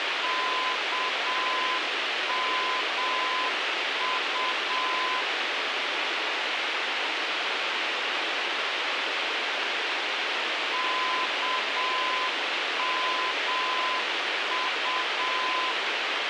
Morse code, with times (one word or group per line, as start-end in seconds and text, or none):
0.2-5.2 KMU
10.7-15.7 KMU